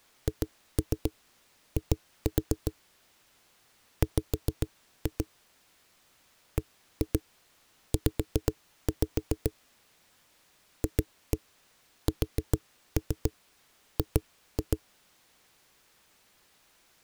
Tap code, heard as knocks on a wall, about 7 knocks a second. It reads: HI W BZ FSG